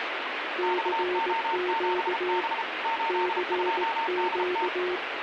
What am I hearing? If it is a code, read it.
Morse code, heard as two keyed tones, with radio static. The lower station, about 18 wpm, 360 Hz: CQ CQ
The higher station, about 33 wpm, 910 Hz: XO7B 82DT